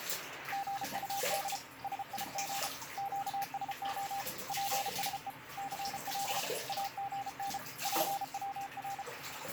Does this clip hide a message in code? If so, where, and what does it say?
Yes: Morse code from 0.5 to 9.1 s, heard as a keyed tone, hand-sent with a paddle, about 33 wpm, 790 Hz, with radio static and the noise of a restroom. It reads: GUD SIG QSO PSE CL AGN PWR